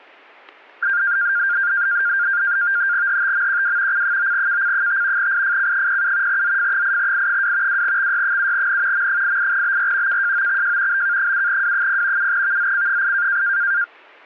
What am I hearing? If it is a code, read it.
NAVTEX (SITOR-B), 100 baud, 170 Hz shift, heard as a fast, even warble, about 1500 Hz centre, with static crashes. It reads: HTMQW C9KC5 IFC07 ZF8I2 2XY7N M88BR KJOXJ BK7W0 7VZC8